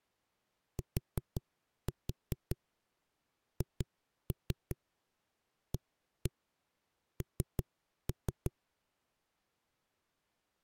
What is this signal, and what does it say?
Tap code, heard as knocks on a wall, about 5 knocks a second. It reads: THAN